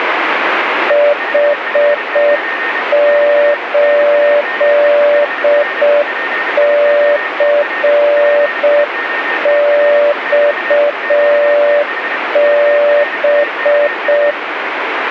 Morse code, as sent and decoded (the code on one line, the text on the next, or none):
.... ---.. -.-. -..- -...
H8CXB